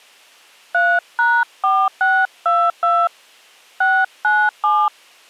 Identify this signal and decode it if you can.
DTMF, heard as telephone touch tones, dialled by hand, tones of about 240 ms. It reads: 3#4622 697